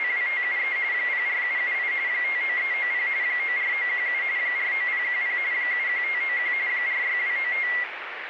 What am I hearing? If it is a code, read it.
RTTY (45.45 baud, 170 Hz shift), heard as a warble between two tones, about 2050 Hz centre, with radio static. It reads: … 04778 59390 94917 49010 71591 46295